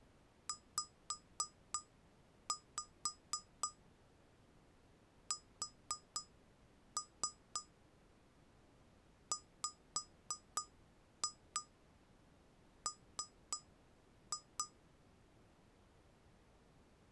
Tap code, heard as taps on glass, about 3 knocks a second. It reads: ZSWM